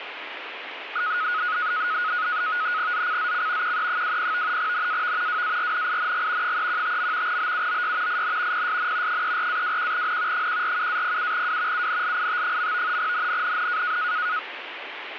NAVTEX (SITOR-B), 100 baud, 170 Hz shift, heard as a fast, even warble, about 1360 Hz centre, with radio static. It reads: ZCZC QE20 NAV WARNING 315. BUOY IN PSN 34-21N 147-07W UNLIT. NNNN